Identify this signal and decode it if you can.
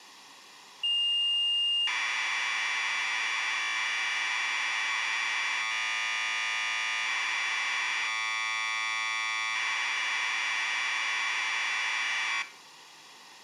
Commodore tape loading (standard loader), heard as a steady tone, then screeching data, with room echo.